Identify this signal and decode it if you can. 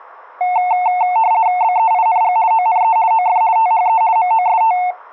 RTTY (50 baud, 170 Hz shift), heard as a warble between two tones, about 810 Hz centre. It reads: BEING ONE OF THE MOST